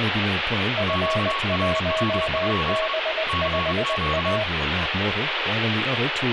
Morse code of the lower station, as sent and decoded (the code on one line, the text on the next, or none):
..-. .---- -... ..... .-
F1B5A